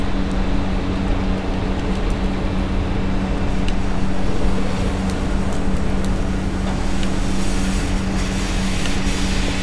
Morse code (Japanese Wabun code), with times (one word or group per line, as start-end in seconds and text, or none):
none